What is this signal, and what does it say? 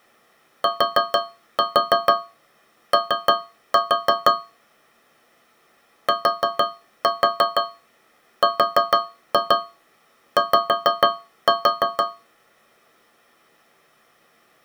Tap code, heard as taps on a metal pipe, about 6 knocks a second. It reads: TO TRY